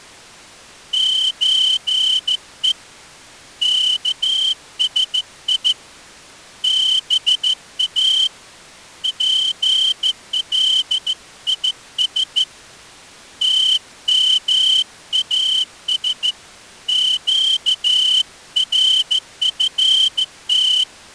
Morse code (Persian alphabet), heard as a whistle, hand-sent with a straight key, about 14 wpm. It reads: چه کسی با پلیس تماس گرفت